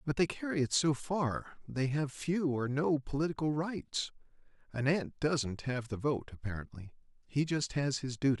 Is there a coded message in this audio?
No, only speech in English.